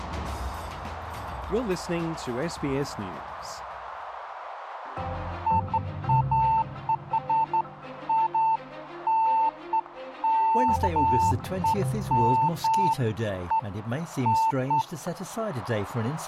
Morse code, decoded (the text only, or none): none